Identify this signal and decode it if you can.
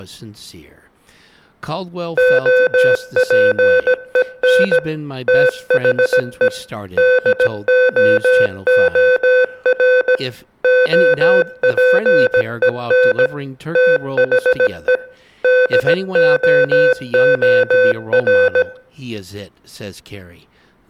Morse code, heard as electronic beeps, machine-sent, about 17 wpm, 510 Hz, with room echo and speech in English. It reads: OPEN THE DOOR OPEN THE DOOR